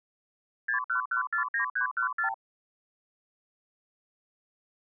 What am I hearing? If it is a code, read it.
Multi-frequency trunk signalling (R2, with the far end's replies), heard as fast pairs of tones, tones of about 110 ms. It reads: 61149314